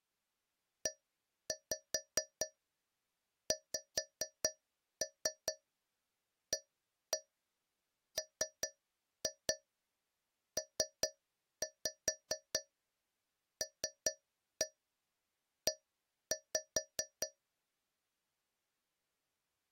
Tap code, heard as taps on a metal pipe, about 4 knocks a second. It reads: EXAMPLE